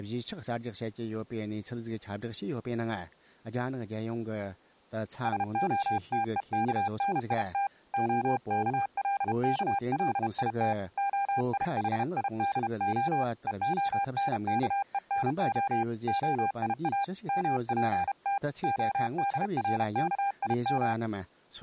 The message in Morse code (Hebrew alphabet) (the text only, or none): שהתוכנית הכלכלית היחידה והנכונה היא מפת הדרכים